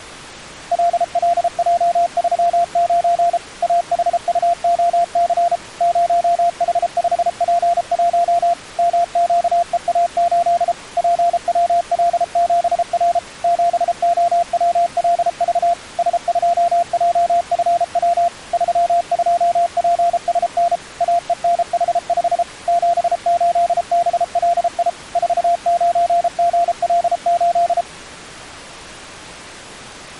Morse code, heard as a keyed tone, machine-sent, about 33 wpm, 690 Hz. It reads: LLJ39 AHUOC 0H5P1 MQEA8 PWL7R 7OWLV S2JFW 32PSN AENH5 78BLI 49GL8